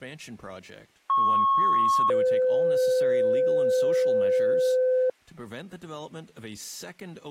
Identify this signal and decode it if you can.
Two-tone page, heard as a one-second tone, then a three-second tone, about 1090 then 510 Hz, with speech in English.